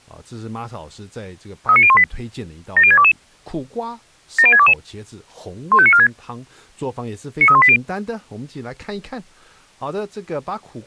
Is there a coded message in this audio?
Yes: five-tone selective call (ZVEI) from 1.7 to 7.8 s, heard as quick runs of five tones, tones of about 70 ms, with speech in Chinese. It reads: 39018 70622 70622 15946 93180